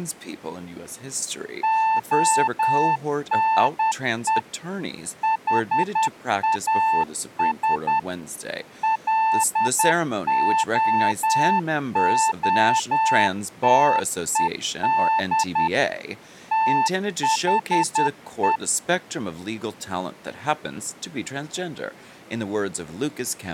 Morse code, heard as a keyed tone, machine-sent, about 10 wpm, 890 Hz, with speech in English. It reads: ONE HAS LOOTED THE